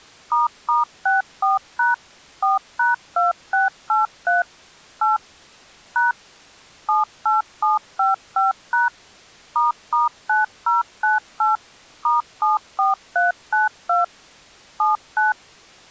DTMF, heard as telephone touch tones, dialled by machine, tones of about 150 ms. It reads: **64# 4#2683 8 # 78755# **9098 *74392 79